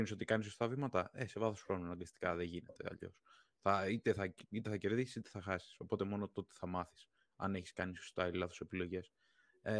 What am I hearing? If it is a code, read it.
Speech in Greek. There is no code.